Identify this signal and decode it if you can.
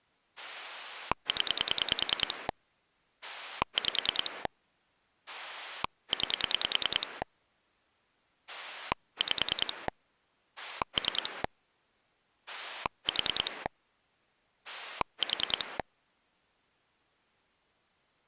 Pulse dialling, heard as a rotary dial, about 10 pulses a second. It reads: 0 5 9 5 3 4 4